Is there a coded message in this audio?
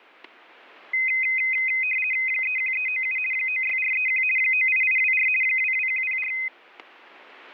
Yes: RTTY (50 baud, 450 Hz shift) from 0.9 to 6.5 s, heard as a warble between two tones, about 2300 Hz centre, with static crashes. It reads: 31397 96431 98824 22104